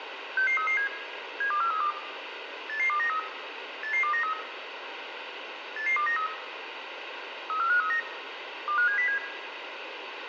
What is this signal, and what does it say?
Five-tone selective call (CCIR), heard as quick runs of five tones, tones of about 100 ms, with radio hiss and room echo. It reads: 66337 72432 88293 88293 88293 34539 25707